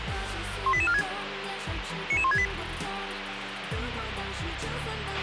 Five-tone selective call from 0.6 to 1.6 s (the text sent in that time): 18846